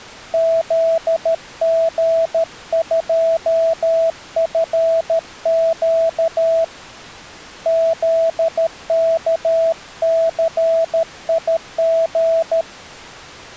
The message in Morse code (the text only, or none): ZG2FQ ZKCIG